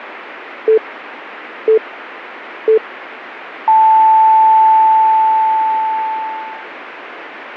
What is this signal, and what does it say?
Radio time signal (three low pips and a long one an octave up, as on NHK), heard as pips.